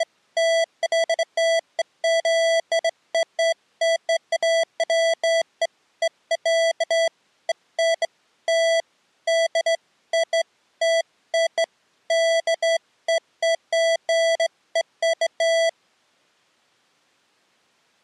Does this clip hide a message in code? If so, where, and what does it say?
No, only beeps of irregular length.